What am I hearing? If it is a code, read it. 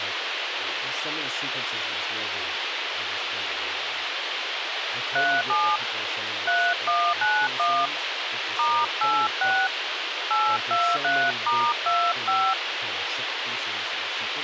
DTMF, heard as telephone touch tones, dialled by hand, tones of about 260 ms, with radio hiss and speech in English. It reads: 37 3191 *86 823*25